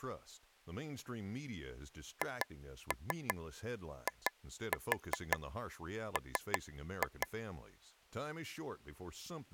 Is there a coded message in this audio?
Yes: tap code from 2.2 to 7.3 s, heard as taps on a table, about 5 knocks a second, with speech in English. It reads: HIM